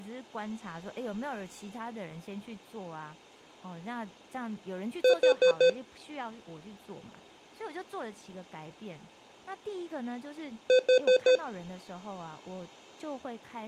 Alarm pattern, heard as an alarm's beeps, played twice, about 510 Hz, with speech in Chinese. Temporal four. Carbon monoxide.